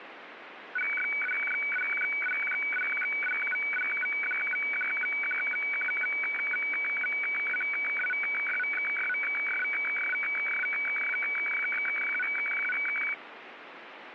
Weather fax (radiofax), 120 lines a minute, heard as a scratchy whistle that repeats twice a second, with radio static.